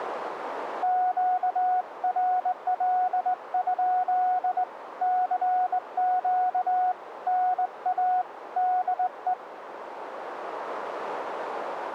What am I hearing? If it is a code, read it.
Morse code, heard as a keyed tone, hand-sent with a straight key, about 20 wpm, 730 Hz, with radio static. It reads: QRL? CQ NA DE